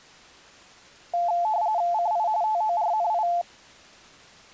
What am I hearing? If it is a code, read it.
RTTY (45.45 baud, 170 Hz shift), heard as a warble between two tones, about 780 Hz centre. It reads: CI TORNI